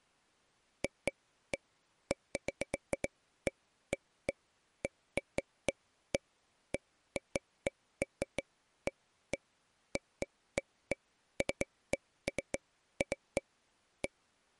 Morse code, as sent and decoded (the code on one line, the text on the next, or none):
none